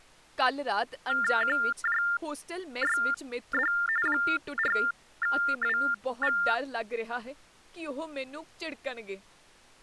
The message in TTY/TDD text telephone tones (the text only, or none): QJYD 4WV